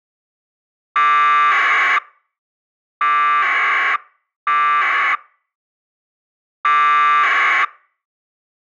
Packet radio (AX.25, as in APRS), 1200 baud, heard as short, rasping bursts.